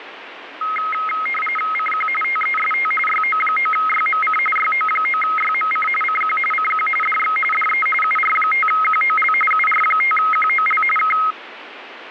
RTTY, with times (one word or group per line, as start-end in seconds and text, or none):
1.7-2.1 CQ
2.2-2.9 TEST
3.1-4.4 YO9YMC
4.6-5.9 YO9YMC
6.0-6.4 CQ
6.5-6.9 CQ
7.0-7.4 DX
7.5-7.9 DE
8.0-9.3 UR5QOL
9.5-10.8 UR5QOL
11.0-11.2 K